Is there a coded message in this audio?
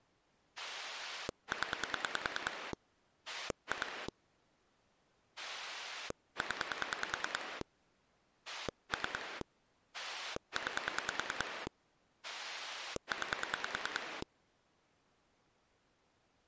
Yes: pulse dialling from 0.6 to 14.2 s, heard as a rotary dial, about 10 pulses a second. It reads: 0 2 0 3 9 9